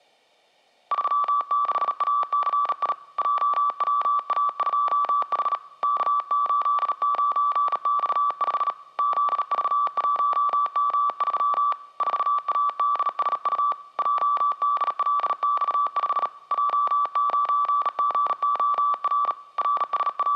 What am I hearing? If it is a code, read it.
Morse code, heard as a keyed tone, hand-sent with a bug key, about 37 wpm, 1160 Hz, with room echo. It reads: 36ACI JWA2H K89X5 ZV1M3 4ADSU JDLX5 J9GOR …